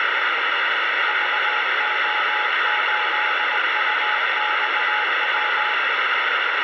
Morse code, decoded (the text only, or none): VO8UXW